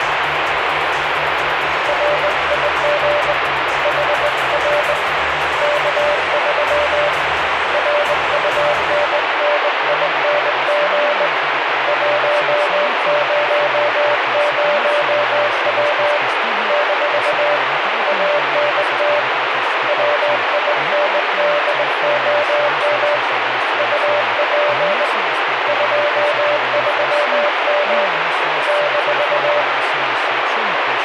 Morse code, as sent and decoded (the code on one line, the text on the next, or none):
.-. .. --. / .... .-. / -.- ...-- / .-. ..- -. -. .. -. --. / .---- ----- ----- .-- / -....- / .- -. - / .-- .. -. -.. --- -- / ..- .--. / ..--- ...-- -- / -....-
RIG HR K3 RUNNING 100W - ANT WINDOM UP 23M -